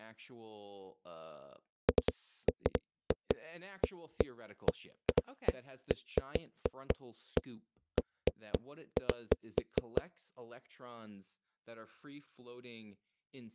Irregular knocks on a wall, with speech in English. There is no code.